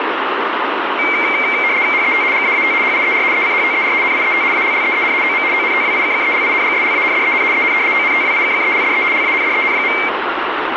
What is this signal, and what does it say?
RTTY (75 baud, 170 Hz shift), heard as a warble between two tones, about 2200 Hz centre, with radio static and room echo. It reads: HET GAAT HIER ECHTER NIET ALLEEN OM ONTWIKKELINGSLANDEN EN ONTWIKKELDE LANDEN.